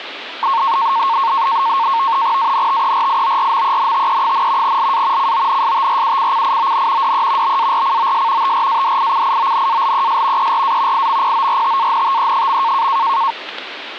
NAVTEX (SITOR-B), 100 baud, 170 Hz shift, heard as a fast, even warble, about 1000 Hz centre, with radio static. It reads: ANTERIORMENTE, LA CONSTRUCCION DE BARCOS TRADICIONALES ERA IMPORTANTE.